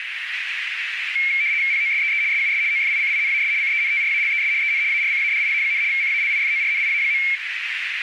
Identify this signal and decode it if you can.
RTTY (75 baud, 170 Hz shift), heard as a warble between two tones, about 2250 Hz centre, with radio static and a narrow filter. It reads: POSEE SUS OFICINAS CENTRALES EN ARCADIA, CALIFORNIA.